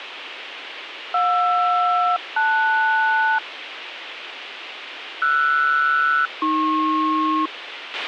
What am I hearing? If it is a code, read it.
Aircraft SELCAL, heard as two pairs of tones, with radio hiss and a squelch burst at the end. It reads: JR-LS RS-AP